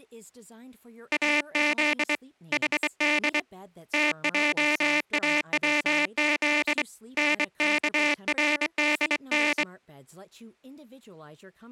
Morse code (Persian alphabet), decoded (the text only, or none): از حد تجاوز نکردن